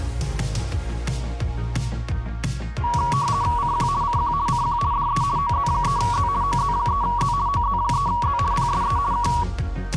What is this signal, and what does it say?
RTTY (50 baud, 170 Hz shift), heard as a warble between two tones, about 1040 Hz centre. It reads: CQ CQ CQ DE OZ3Z OZ3Z OZ3Z PSE K